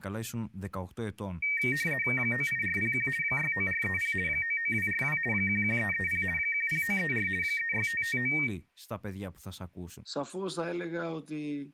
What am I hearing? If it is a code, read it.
RTTY (50 baud, 450 Hz shift), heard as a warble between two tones, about 2050 Hz centre, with speech in Greek. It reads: 98401 69430 99242 11330 10934 36559